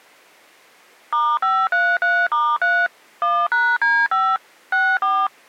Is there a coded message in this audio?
Yes: DTMF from 1.1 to 5.3 s, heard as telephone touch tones, dialled by machine, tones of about 250 ms. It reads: *533*3 1#D5 64